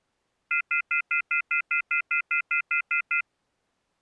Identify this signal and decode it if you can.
Telephone call progress tone (North American plan), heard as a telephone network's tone, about 1400, 2050, 2450, 2600 Hz, 0.1 s on and 0.1 s off. Off-hook warning tone.